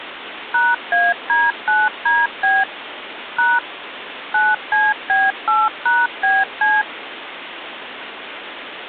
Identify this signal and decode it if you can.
DTMF, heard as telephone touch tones, dialled by machine, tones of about 200 ms, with phone line noise. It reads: #AD9DB # 9CB8#BC